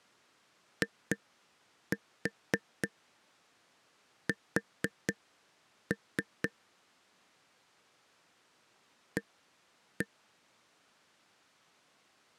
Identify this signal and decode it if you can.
Tap code, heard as taps on a table, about 4 knocks a second. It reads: IS A